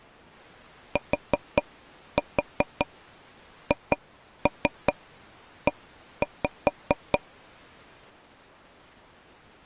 Tap code, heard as taps on a table, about 5 knocks a second. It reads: THE